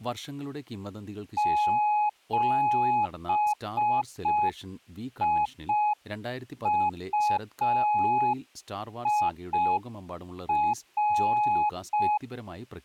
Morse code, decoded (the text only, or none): 7IUIR